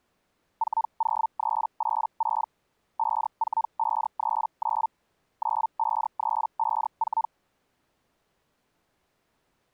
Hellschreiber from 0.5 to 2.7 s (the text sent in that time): 40386